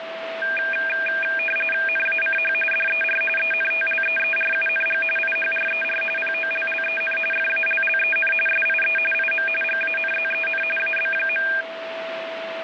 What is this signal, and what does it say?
RTTY (45.45 baud, 850 Hz shift), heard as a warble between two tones, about 2000 Hz centre, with radio static and a steady whistle near 660 Hz. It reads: NACH DER ENTLEERUNG IHRER POLLEN FALLEN SIE IM GANZEN AB.